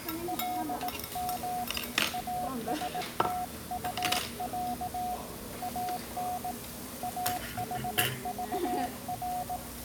Morse code (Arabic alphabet), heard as a keyed tone, hand-sent with a paddle, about 18 wpm, 730 Hz, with the noise of a restaurant. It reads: لم استطع ان احضر